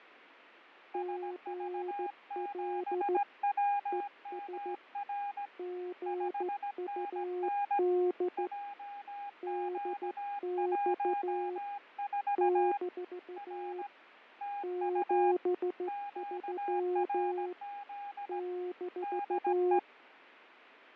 Morse code, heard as two keyed tones, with radio static and fading. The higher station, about 17 wpm, 810 Hz: SV7WMR 5NN JQ14 R TU QRZ DE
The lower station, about 14 wpm, 360 Hz: GL ES GUD DX - 73 -